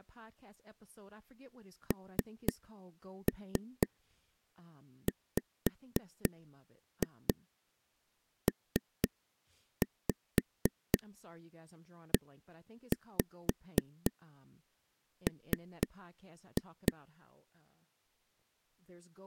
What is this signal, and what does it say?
Tap code, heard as taps on a table, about 4 knocks a second, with speech in English. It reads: NWPEM